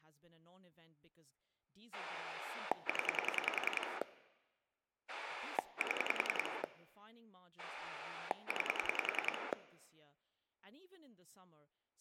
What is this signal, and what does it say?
Pulse dialling, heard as a rotary dial, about 10 pulses a second, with speech in English. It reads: 0 7 9